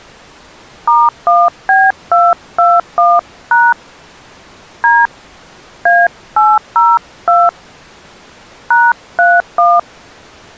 DTMF, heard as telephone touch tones, dialled by hand, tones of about 220 ms. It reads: *1B221# D A802 #31